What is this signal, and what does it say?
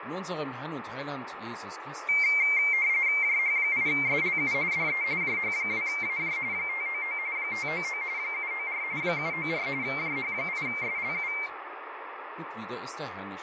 RTTY (45.45 baud, 170 Hz shift), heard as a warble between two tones, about 2200 Hz centre, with radio static and fading. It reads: JH8SLU DE JH2AJ 599 599 794 794 JH8SLU